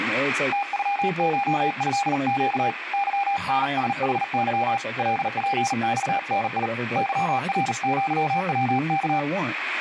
Morse code (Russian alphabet), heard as a keyed tone, hand-sent with a paddle, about 39 wpm, 800 Hz, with speech in English. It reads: ТЮШЭЩ ЫНСХЫ ЛПЬНИ ЫРЪВК